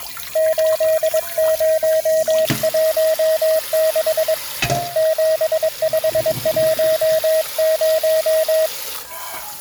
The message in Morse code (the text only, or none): 8016 7510